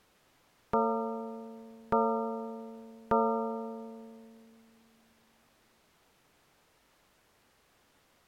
Clock strike, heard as a bell. 3. Three o'clock.